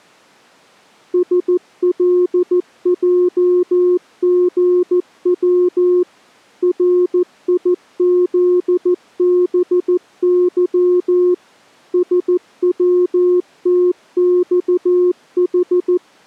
Morse code, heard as a keyed tone, machine-sent, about 14 wpm, 360 Hz. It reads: SLJGW RIZBY SWTXH